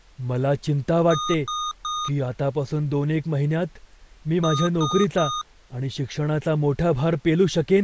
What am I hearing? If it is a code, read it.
Beep code, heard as beeps from a small speaker, played twice, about 1230 Hz, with speech in Marathi. 3 short. In AMI BIOS tables: failure in the first 64 KB of memory; in Dell tables: chipset error.